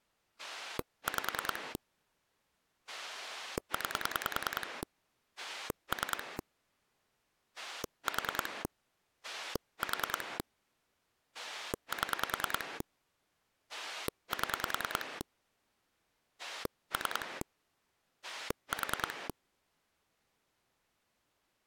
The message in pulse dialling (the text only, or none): 5 9 3 4 4 7 7 3 4